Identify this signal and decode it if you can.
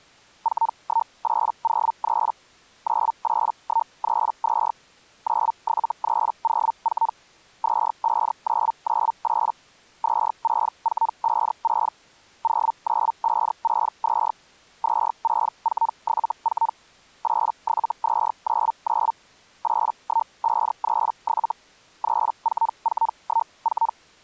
Hellschreiber (Feld-Hell, 122.5 baud), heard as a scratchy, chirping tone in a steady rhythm, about 910 Hz. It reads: 41803 98132 97304 25998 26456 09562 26474 87299 81537 34414